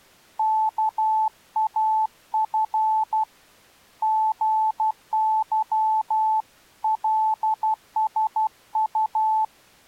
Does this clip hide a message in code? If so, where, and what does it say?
Yes: Morse code (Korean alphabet) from 0.3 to 9.5 s, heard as a keyed tone, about 12 wpm, 870 Hz. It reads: 온 세계